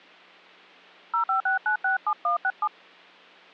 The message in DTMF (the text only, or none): 056967167